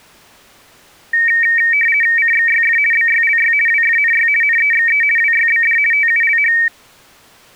RTTY (50 baud, 450 Hz shift), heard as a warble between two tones, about 2050 Hz centre. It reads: CXYF BYLY WFNY NEXE WYBD TULH